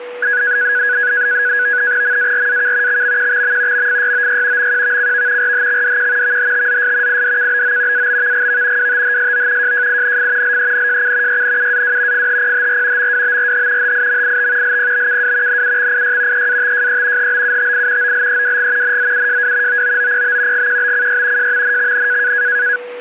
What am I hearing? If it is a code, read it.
NAVTEX (SITOR-B), 100 baud, 170 Hz shift, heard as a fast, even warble, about 1550 Hz centre, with a steady whistle near 490 Hz. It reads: MARAK XMQXM MFYOY MQVCV RHXDQ VHTZS IDKBO ABVGV WTHSO JJINF LENJC YNUAW FHPHR MWBRH HIMIT LPBKW NUXIY EATJE HBUTI OLEWG NZUJW OOOPB GQBCY JMNXN